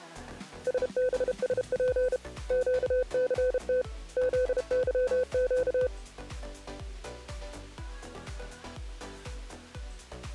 Morse code, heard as a keyed tone, hand-sent with a paddle, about 32 wpm, 510 Hz. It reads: SBSP QCT ZYQ